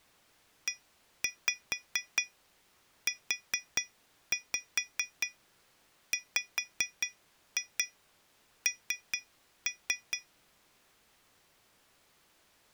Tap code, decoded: EUWN

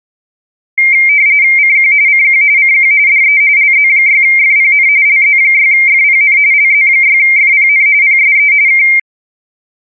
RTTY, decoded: CQ CQ CQ DE LZ6FPN LZ6FPN LZ6FPN PSE K

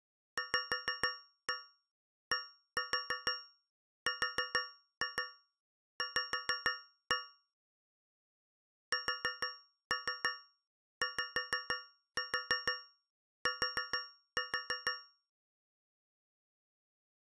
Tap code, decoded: VDRV SYT

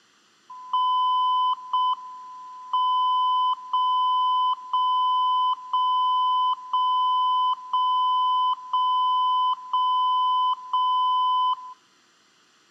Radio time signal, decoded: 0 M 0 0 0 0 0 0 0 0 0

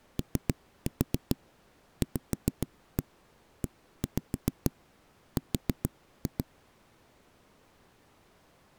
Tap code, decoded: OVER

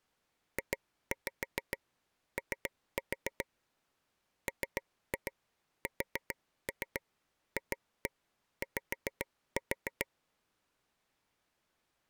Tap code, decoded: JO MSFY

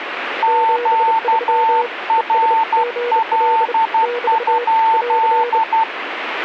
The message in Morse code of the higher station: QRL?

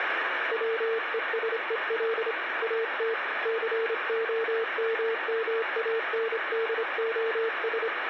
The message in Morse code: WESEL AT COMMANDOS

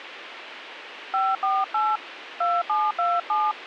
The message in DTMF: 548 2727

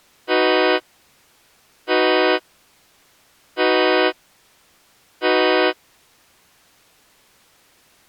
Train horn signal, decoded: 4 short

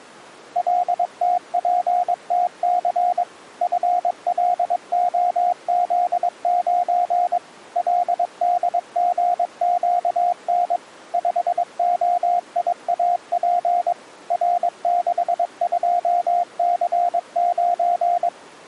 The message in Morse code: LTPTC FLOZ9 LDGQN 5OIAP R62C9

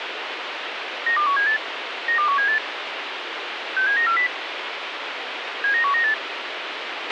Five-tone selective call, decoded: 92178 92178 67940 79198

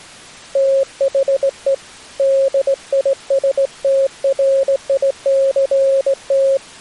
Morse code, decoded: THE DISTRICT

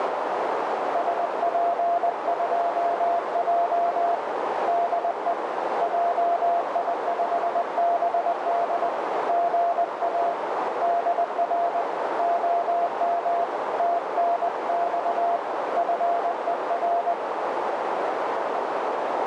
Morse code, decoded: SP2J DE JI5BD GA DR OM TNX FER

